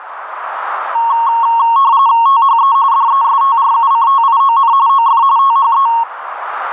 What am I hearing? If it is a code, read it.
RTTY (45.45 baud, 170 Hz shift), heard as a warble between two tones, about 1010 Hz centre, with radio static and a narrow filter. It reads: THE DESTRUCTION OF THE